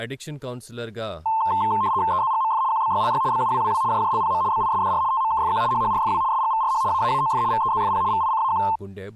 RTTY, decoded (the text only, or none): EZGMF QBYLY BUWWW JJLPM BISDR TMKFQ HHRFW SGVRH AAAOF VEZFP VICAQ